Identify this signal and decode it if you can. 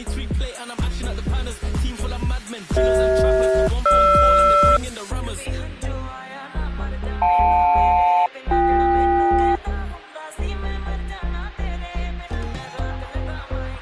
Aircraft SELCAL, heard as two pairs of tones. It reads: CH-GR JL-BK